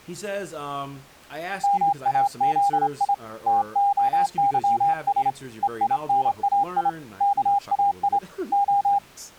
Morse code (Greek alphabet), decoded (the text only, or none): ΜΑΖΙ ΤΟΥΣ ΕΙΝΑΙ ΚΑΙ Ο